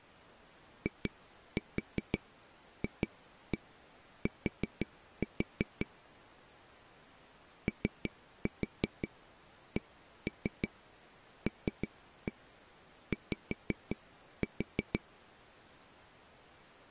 Tap code, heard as taps on a table, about 5 knocks a second. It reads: IFT OCLY